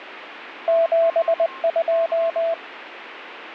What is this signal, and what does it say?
Morse code, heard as a keyed tone, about 20 wpm, 660 Hz, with radio static and a weaker station near 1070 Hz. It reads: 72